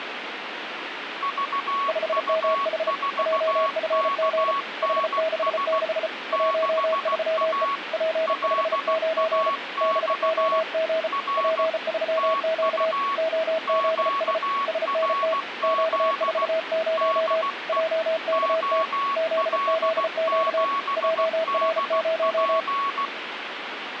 Morse code, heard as two keyed tones, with radio static. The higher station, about 16 wpm, 1120 Hz: VU4KNS 6A LAX R TU QRZ DE OL7DP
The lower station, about 34 wpm, 640 Hz: 5MH JFG H66 13E P59 BOG P3Q OZS SNT Q40 JKT ZZQ JR0